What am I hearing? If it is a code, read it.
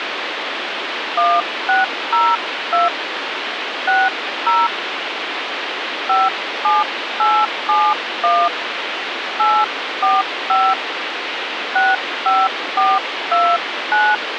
DTMF, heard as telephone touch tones, dialled by hand, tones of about 210 ms, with phone line noise. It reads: 1602 60 57871 845 65429